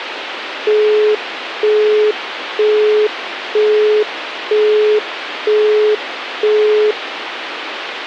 Telephone call progress tone (single-tone plan, as in Europe, Japan and elsewhere), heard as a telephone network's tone, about 420 Hz, 0.48 s on and 0.48 s off, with phone line noise. Busy tone.